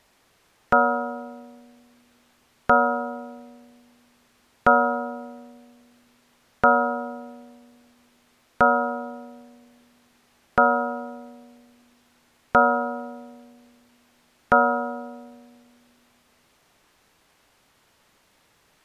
Clock strike, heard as a bell. 8. Eight o'clock.